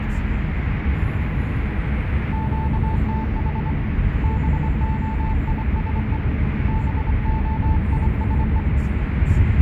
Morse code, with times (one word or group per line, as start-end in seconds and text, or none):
2.3-3.7 QTH
4.2-6.2 BOISE
6.7-8.6 BOISE